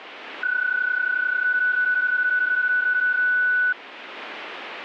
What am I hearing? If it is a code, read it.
PSK31 (31.25 baud), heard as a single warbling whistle, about 1490 Hz.